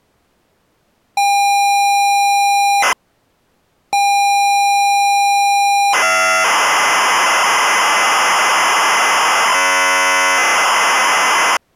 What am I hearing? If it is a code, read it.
ZX Spectrum tape loading, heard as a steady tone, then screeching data.